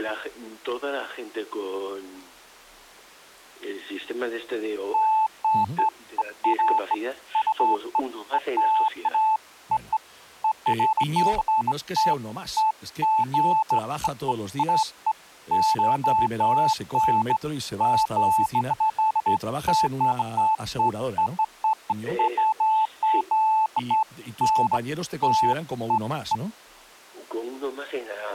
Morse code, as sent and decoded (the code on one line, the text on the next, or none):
none